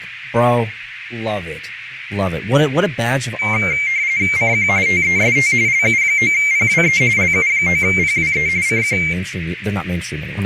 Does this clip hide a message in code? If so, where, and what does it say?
Yes: RTTY (45.45 baud, 170 Hz shift) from 3.4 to 9.1 s, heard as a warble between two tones, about 2200 Hz centre, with radio static, a narrow filter and speech in English. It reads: CQ TEST LU9PWE LU9PWE CQ